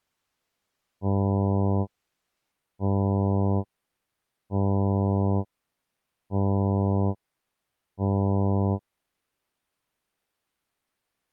Ship horn signal, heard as a ship's horn, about 100 Hz. 5 short. At sea: I doubt that you are doing enough to avoid a collision.